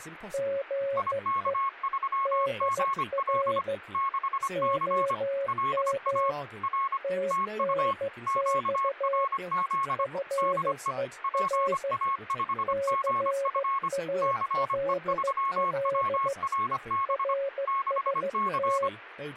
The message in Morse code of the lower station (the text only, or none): GE DR OM TNX FER CALL RST